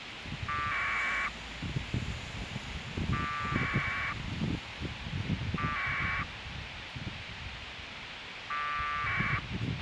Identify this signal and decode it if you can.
Packet radio (AX.25, as in APRS), 1200 baud, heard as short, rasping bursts, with radio hiss, a squelch burst at the end and street noise.